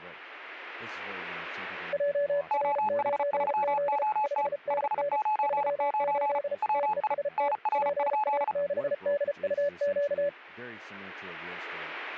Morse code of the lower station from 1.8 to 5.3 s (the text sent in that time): JR9Z 5NN